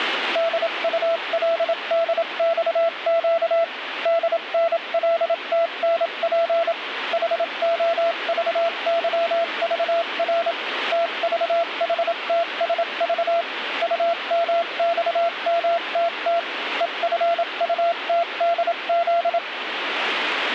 Morse code, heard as a keyed tone, machine-sent, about 27 wpm, spaced as for 24 wpm, 670 Hz, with radio static. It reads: DULDXQ DNLTNP HOVYVR TVHTSV UMXMTT EFUTDZ